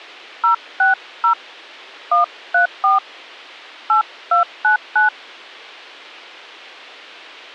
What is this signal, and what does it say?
DTMF, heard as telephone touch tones, dialled by hand, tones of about 130 ms. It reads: 060 134 8299